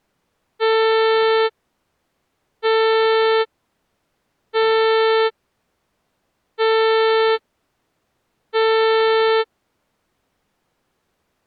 Ship horn signal, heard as a ship's horn, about 440 Hz. 5 short. At sea: I doubt that you are doing enough to avoid a collision.